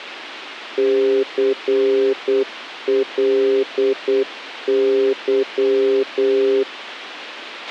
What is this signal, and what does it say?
Morse code, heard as a keyed tone, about 8 wpm, 400 Hz, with a squelch burst at the end. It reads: CLY